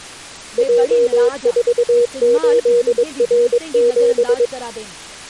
Morse code, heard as a keyed tone, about 22 wpm, 480 Hz, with speech in Dogri. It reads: J48R7